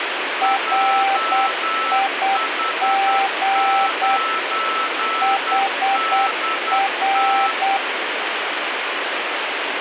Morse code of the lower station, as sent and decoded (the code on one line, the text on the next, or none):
.-. .. --. / .... .-.
RIG HR